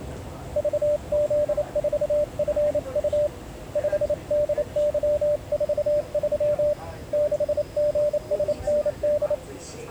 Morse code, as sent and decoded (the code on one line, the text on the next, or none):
...- --.. ....- ..-. ..- / ..... -.. -.-- ....- ...-- / -.... --. ... -. -..
VZ4FU 5DY43 6GSND